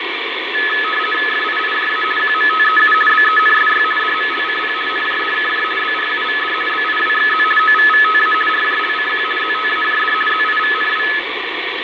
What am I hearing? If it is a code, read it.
RTTY (50 baud, 450 Hz shift), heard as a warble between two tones, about 1500 Hz centre, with radio static and fading. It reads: FIIJA QMTEU BENSY DMLCP NJDKJ BRUVD BIWXZ OVVTA RJLCQ ZTAJD ZIVNW